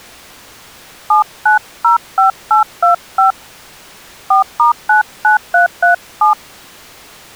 DTMF, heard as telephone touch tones, dialled by hand, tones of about 120 ms. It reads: 7905825 4*99337